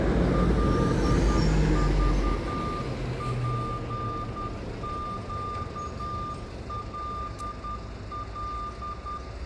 Morse code, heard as a keyed tone, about 10 wpm, 1200 Hz, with room echo and street noise. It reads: LVPQLL